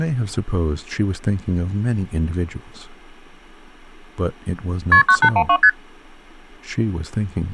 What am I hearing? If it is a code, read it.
Multi-frequency trunk signalling (R1, as on North American trunks), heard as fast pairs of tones, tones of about 70 ms, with speech in English. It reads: KP 9812 ST